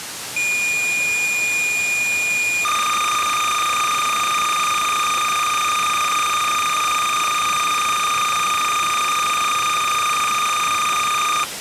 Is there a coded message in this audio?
Yes: cassette data (Kansas City type), 300 baud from 0.4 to 11.4 s, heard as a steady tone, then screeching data, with tape hiss.